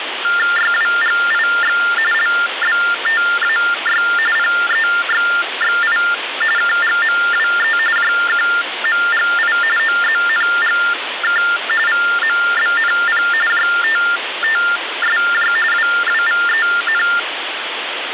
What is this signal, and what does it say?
TTY/TDD text telephone tones (45.45 baud Baudot), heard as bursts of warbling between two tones, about 400 Hz shift, 1600 Hz centre, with phone line noise. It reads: YWGIX LBTAY PEXXI KGMWE JQMGI OZNGK VMBNP JTTSJ WWVEN